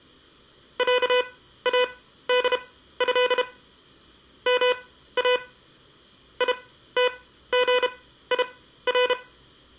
Morse code (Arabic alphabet), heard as electronic beeps, machine-sent, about 32 wpm, spaced as for 15 wpm, 500 Hz, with room echo. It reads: عاده ما يتغير